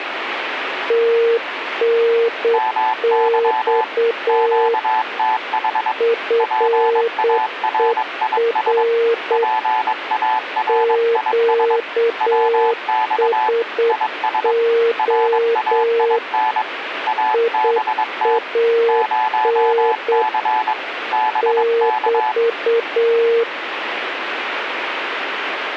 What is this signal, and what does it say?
Morse code, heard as two keyed tones, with radio static. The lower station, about 8 wpm, 460 Hz: TNX FER QSO IAN <BT>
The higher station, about 22 wpm, 870 Hz: MY QTH PARIS PARIS WX IS RAIN ABT 0C BK